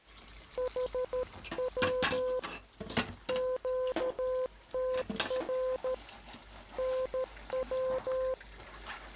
Morse code, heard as a keyed tone, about 13 wpm, 510 Hz, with kitchen noise. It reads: HW QTR NW